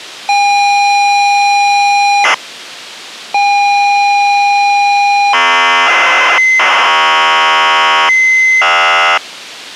ZX Spectrum tape loading, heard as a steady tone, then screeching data.